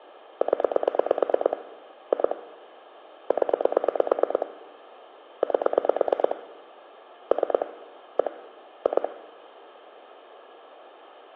Pulse dialling, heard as clicks on a phone line, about 9 pulses a second, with phone line noise and room echo. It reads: 0 2 0 8 3 1 2